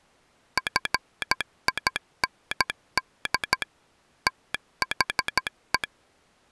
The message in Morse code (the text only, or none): FIND THE